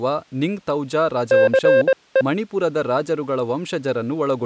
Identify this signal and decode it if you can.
Morse code, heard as a keyed tone, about 21 wpm, 530 Hz, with speech in Kannada. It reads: CE